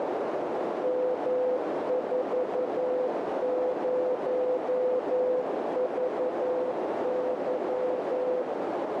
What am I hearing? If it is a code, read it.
Morse code, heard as a keyed tone, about 11 wpm, 500 Hz, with heavy radio static and a narrow filter. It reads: M40VY